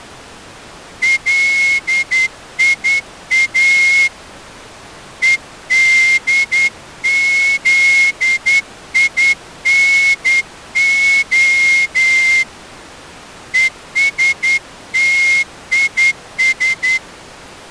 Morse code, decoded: LIA EDZINO ESTIS

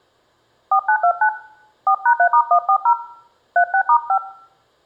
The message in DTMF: 4929 4#3*140 36*5

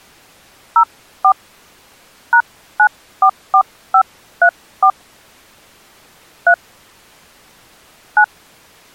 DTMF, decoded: 04 #944534 3 9

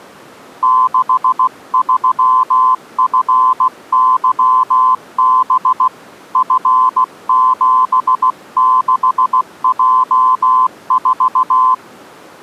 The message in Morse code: 63FYB F76J4

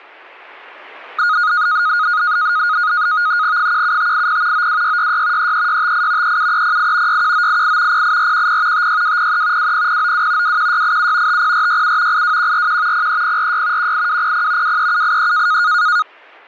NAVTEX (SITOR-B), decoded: 17580 92666 33658 37308 61988 08410 56203 20092 21687 50467 82141 03046 18200 23783

